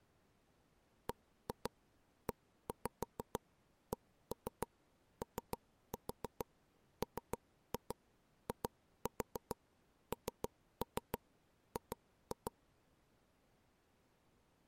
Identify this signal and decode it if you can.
Tap code, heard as taps on a table, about 6 knocks a second. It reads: BECOMING